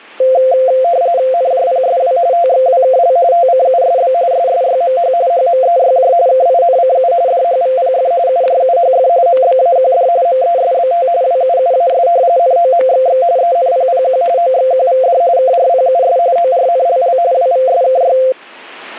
RTTY (45.45 baud, 170 Hz shift), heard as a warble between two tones, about 600 Hz centre, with static crashes. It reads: NJPSW TXWKL TCUSB SSYMH HMEYJ KINCU DHVPF UJUHF MBAQD MESBT WUUAS NOMXX ENPPQ OXQVD KRPUS ORNLL WVSKY